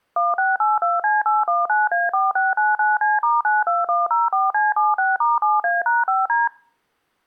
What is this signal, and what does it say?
DTMF, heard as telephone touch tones, dialled by machine, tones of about 180 ms. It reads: 1682C819A4699C*92104C76*7A#5D